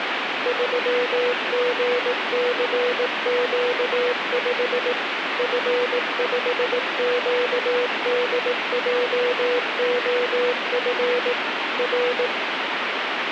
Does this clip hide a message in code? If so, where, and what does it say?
Yes: Morse code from 0.4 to 12.3 s, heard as a keyed tone, machine-sent, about 18 wpm, 490 Hz, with radio static. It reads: 3GCQ5 F5QDJOF R